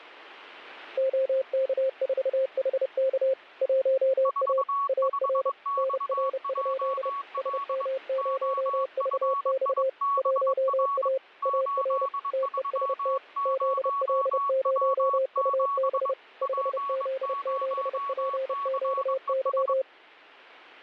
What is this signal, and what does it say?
Morse code, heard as two keyed tones, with radio static. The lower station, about 30 wpm, 530 Hz: OK4HK 1A AR NR? SM0VX 1A AR TEST ZL0UB 5Z7PQY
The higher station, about 22 wpm, 1120 Hz: 45XJL OFIBR 830W7 P0CES